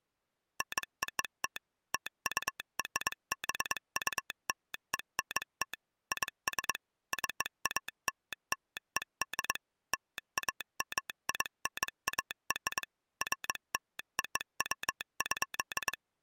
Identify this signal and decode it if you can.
Morse code (American railroad code), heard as a telegraph sounder, machine-sent. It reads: NOT TURBULENT IS CALLED LAMINAR FLOW.